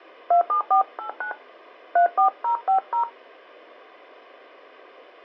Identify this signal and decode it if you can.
DTMF, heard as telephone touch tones, dialled by hand, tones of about 110 ms. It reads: 27489 34050